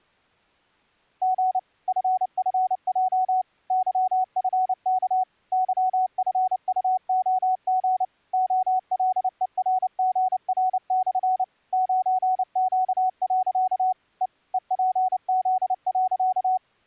Morse code, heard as a keyed tone, machine-sent, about 29 wpm, 750 Hz. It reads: G FFJ YFK YFUOG OLERGR/ 9Q. E EPZ.